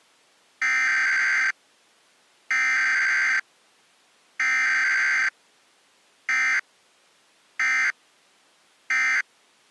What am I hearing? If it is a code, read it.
Emergency Alert System (SAME) tones (header bursts, then end-of-message bursts), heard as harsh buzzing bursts, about 520.83 baud.